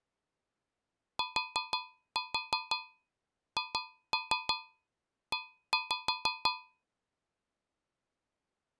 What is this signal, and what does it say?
Tap code, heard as taps on a metal pipe, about 6 knocks a second. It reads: THE